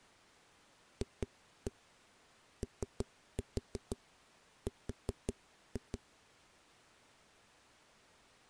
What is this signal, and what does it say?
Tap code, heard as knocks on a wall, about 5 knocks a second. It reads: FOR